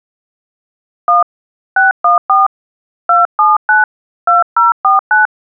DTMF, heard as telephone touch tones, dialled by hand, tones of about 160 ms. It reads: 1 614 279 2049